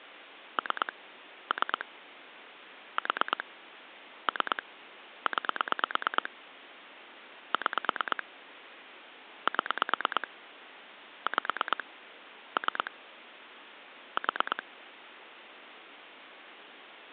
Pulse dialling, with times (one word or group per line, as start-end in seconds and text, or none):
0.6-0.9 3
1.5-1.9 3
3.0-3.4 4
4.3-4.6 3
5.3-6.3 9
7.5-8.2 6
9.5-10.3 7
11.3-11.8 5
12.6-12.9 3
14.2-14.6 4